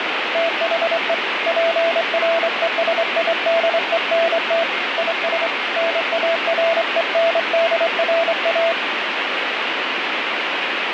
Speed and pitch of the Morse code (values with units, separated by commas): 26 wpm, 670 Hz